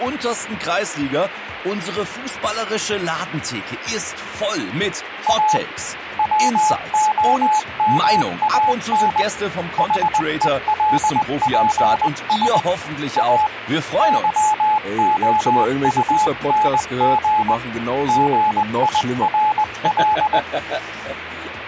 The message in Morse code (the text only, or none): A WOMAN HELPS A YOUNG GIRL